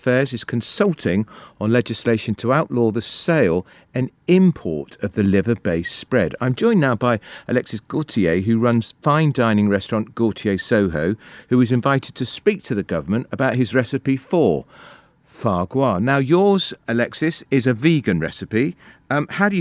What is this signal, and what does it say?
Speech in English. There is no code.